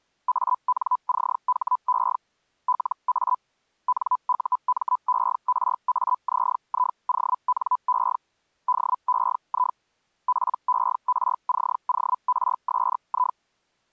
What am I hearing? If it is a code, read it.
Hellschreiber (Feld-Hell, 122.5 baud), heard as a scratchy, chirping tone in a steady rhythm, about 1000 Hz. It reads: ANCHE LA NUMERAZIONE DEI PERCORSI